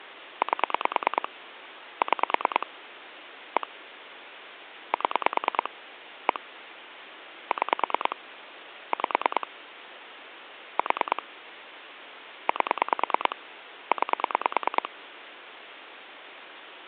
Pulse dialling, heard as clicks on a phone line, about 9 pulses a second, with phone line noise. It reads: 8 6 1 7 1 6 5 4 8 9